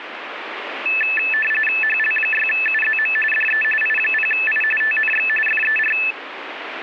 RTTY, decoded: HL6UZM DE I0I TNX FER

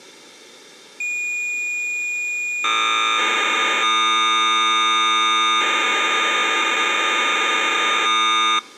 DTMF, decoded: none

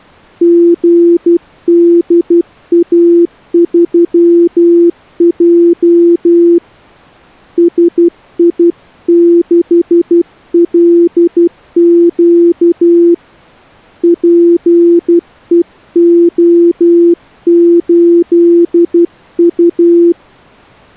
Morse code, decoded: GDA3J SI6LQ PEO8U

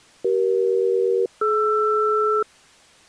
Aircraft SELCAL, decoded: CE-DR

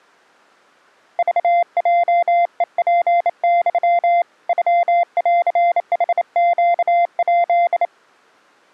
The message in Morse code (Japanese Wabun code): クヲヘツユ ノンヌネヱ

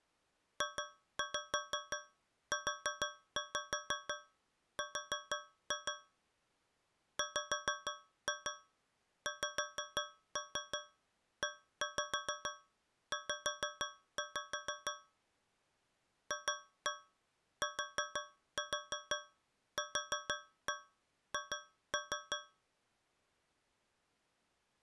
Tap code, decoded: JUR WXEZ FTQH

